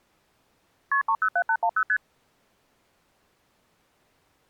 Multi-frequency trunk signalling (R1, as on North American trunks), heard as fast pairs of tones, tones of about 70 ms. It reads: KP 307810 ST